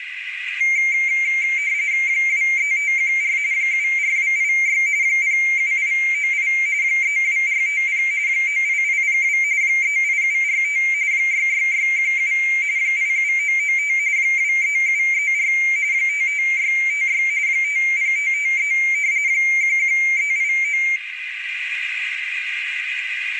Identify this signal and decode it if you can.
RTTY (45.45 baud, 170 Hz shift), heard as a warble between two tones, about 2200 Hz centre, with radio static, a narrow filter and room echo. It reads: 23514 74286 07898 32450 98802 38745 66617 87995 23734 55656 50553 11389